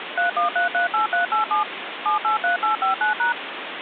DTMF, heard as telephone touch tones, dialled by machine, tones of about 130 ms, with phone line noise. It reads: 31338387 783859#